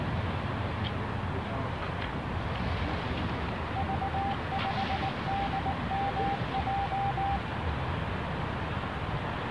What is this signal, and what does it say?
Morse code, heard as a keyed tone, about 19 wpm, 790 Hz, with radio static, a narrow filter and the noise of a residential street. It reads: V5DMJ